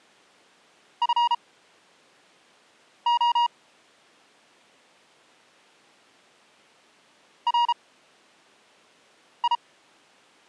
Morse code, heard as a keyed tone, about 33 wpm, spaced as for 5 wpm, 950 Hz. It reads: FO RI